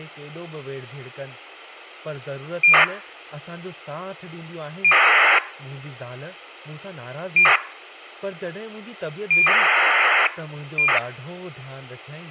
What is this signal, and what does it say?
ACARS aircraft data, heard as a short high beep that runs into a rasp, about 2400 baud, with speech in Sindhi.